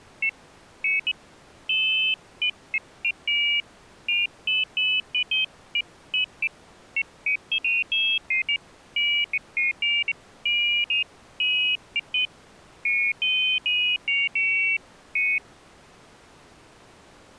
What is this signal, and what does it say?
Pairs of high tones at irregular times. There is no code.